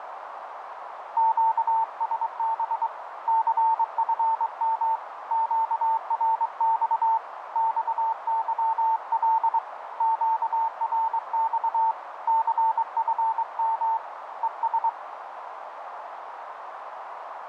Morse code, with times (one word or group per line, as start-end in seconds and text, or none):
1.2-2.9 QSB
3.3-5.0 CFM
5.3-7.2 QRX
7.6-9.6 XYL
10.0-11.9 QRX
12.3-14.0 CFM
14.4-14.9 ES